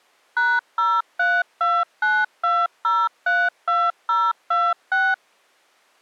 DTMF, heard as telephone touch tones, dialled by machine, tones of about 230 ms. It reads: #03292032026